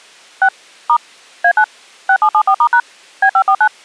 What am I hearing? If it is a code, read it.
DTMF, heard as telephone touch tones, dialled by machine, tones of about 70 ms. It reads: 6 * A9 6774*# B549